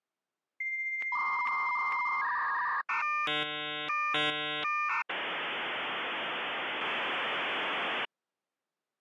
Dial-up modem handshake (V.34 or later), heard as a whistle, warbles, then hiss.